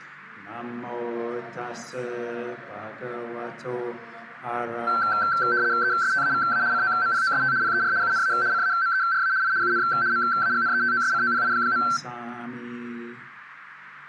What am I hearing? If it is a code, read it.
RTTY (75 baud, 170 Hz shift), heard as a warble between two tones, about 1450 Hz centre. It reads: ESTAVA COMPOST PER UNA CAMERA I UN MAGNETOSCOPI.